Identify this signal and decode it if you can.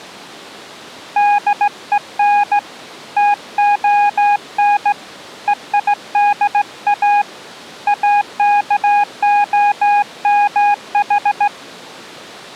Morse code (Greek alphabet), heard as a keyed tone, hand-sent with a straight key, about 16 wpm, 820 Hz. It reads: ΔΕΝ ΤΟΝ ΕΙΔΑ ΑΚΟΜΗ